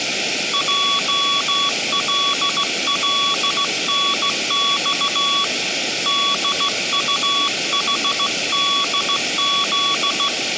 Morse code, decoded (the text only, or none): JLLNX DUHDZ